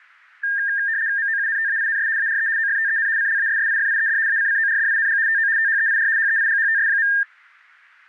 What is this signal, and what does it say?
RTTY (75 baud, 170 Hz shift), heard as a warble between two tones, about 1700 Hz centre. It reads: MOUNTAINS ARE OFTEN CLASSIFIED ACCORDING TO THEIR HEIGHTS.